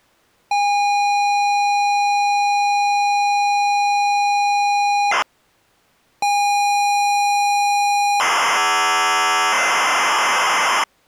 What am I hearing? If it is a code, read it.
ZX Spectrum tape loading, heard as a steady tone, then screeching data.